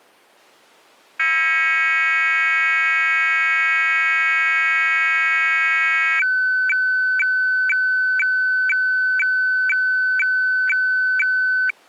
Weather fax (radiofax), 120 lines a minute, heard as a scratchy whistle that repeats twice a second.